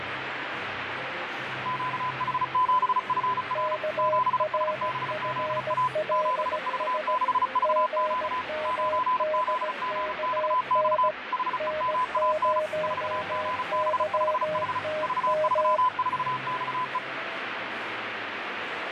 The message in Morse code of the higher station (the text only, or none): QH7FR 7SBZA 7V6VQ 9ZGXX HEMAN 4GB5H V34XE